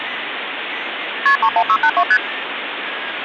Multi-frequency trunk signalling (R1, as on North American trunks), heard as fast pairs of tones, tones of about 70 ms, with phone line noise. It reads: KP 31682 ST